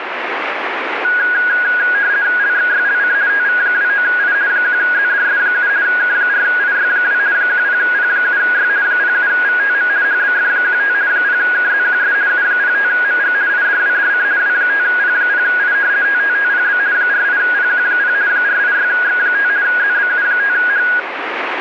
RTTY (50 baud, 170 Hz shift), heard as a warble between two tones, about 1550 Hz centre, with radio static. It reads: LXYLC TV29I 1ZDS7 K4IY2 10P7Y 07VTM HBF15 0KZQS U05MG IDWDC W5P0I TTTPB 48PQ0 486X5 ZBU5H